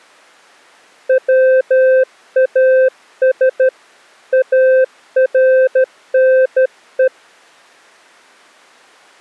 Morse code, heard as a keyed tone, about 13 wpm, 520 Hz. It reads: WAS ARNE